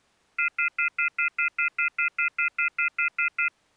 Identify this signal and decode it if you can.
Telephone call progress tone (North American plan), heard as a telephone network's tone, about 1400, 2050, 2450, 2600 Hz, 0.1 s on and 0.1 s off. Off-hook warning tone.